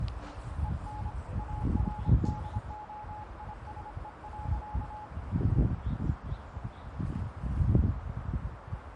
Morse code, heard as a keyed tone, hand-sent with a paddle, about 26 wpm, 850 Hz, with radio static, a narrow filter and the noise of a residential street. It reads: EN ARDOISE.